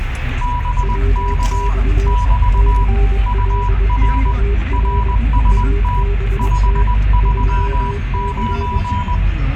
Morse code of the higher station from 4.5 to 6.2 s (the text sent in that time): RST